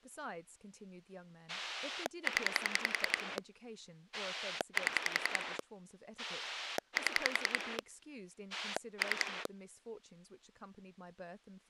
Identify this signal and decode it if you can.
Pulse dialling, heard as a rotary dial, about 10 pulses a second, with speech in English. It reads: 0 7 7 3